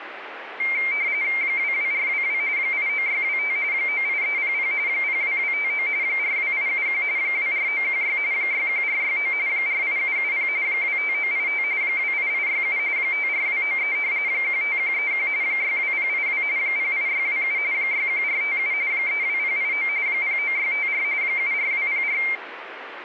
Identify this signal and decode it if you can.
RTTY (45.45 baud, 170 Hz shift), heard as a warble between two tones, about 2200 Hz centre, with radio static. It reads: 22422 89625 98300 02259 42871 24916 61469 48770 25985 28867 54293 15131 62082 08627 61457 32089 09654 74204